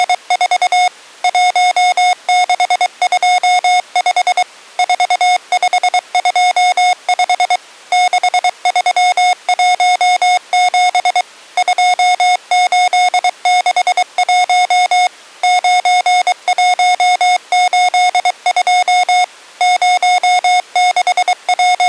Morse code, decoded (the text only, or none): … 1625 4525 6317 2861 9182 …